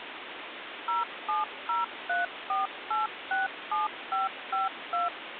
DTMF, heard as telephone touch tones, dialled by machine, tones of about 160 ms, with phone line noise. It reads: 07034867552